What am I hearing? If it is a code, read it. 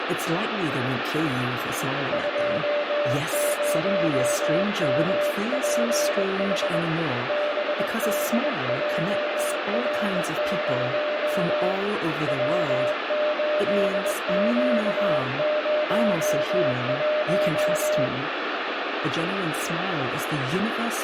Morse code, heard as a keyed tone, hand-sent with a bug key, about 21 wpm, 600 Hz, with radio static, a weaker station near 2060 Hz and room echo. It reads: 20MPH BDJR0 W8Q01